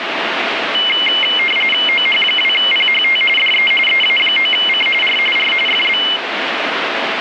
RTTY (45.45 baud, 850 Hz shift), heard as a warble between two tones, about 2550 Hz centre, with radio static. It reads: OH2PHT DE EA9C R R FB